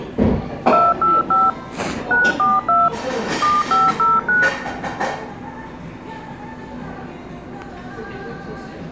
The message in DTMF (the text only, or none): 285 942 7509